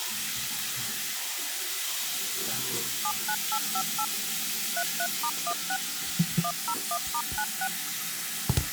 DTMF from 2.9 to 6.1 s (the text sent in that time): 79858 33*16